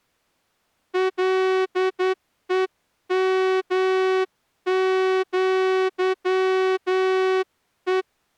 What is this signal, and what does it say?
Morse code (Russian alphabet), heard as a horn, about 10 wpm. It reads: ЛЕМЪЕ